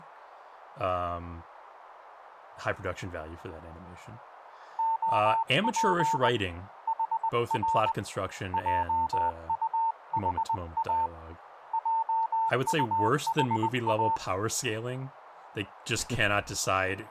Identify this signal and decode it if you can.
Morse code, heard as a keyed tone, hand-sent with a paddle, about 20 wpm, 900 Hz, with radio static and speech in English. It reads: OP HR JUHA JUHA